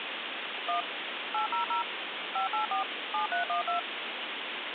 DTMF, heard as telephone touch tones, dialled by machine, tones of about 120 ms, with phone line noise. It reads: 1 800 584 7312